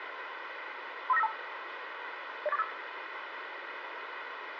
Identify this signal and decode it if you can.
Five-tone selective call (EIA), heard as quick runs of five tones, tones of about 30 ms, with radio hiss, a squelch burst at the end and room echo. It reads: 35952 08485